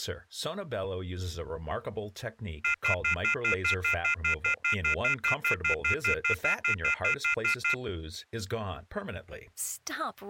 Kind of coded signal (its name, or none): telephone call progress tone